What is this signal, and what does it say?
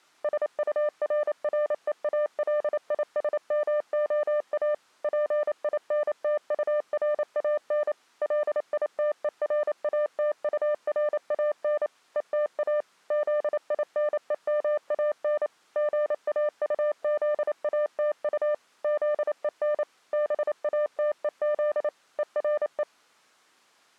Morse code, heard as a keyed tone, machine-sent, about 28 wpm, 600 Hz. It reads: SURREALISMOA PINTURAN LITERATURAN ETA ZINEMAN GAUZATU ZEN BATEZ ERE